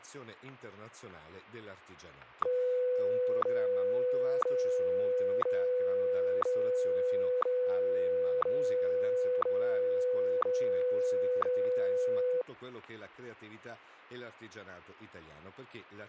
Radio time signal (WWVH, Hawaii), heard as ticks, one a second, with static crashes and speech in Italian.